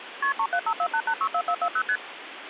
Multi-frequency trunk signalling (R1, as on North American trunks), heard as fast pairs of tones, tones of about 70 ms, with phone line noise. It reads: KP 37548864440 ST